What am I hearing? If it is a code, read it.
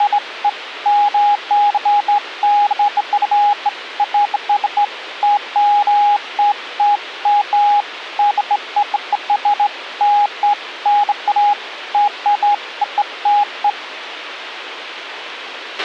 Beeps of irregular length, with radio hiss and a squelch burst at the end. There is no code.